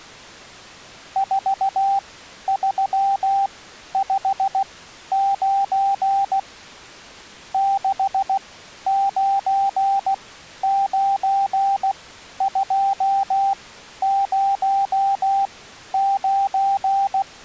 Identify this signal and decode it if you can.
Morse code, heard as a keyed tone, machine-sent, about 16 wpm, spaced as for 11 wpm, 790 Hz. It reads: 4359 699209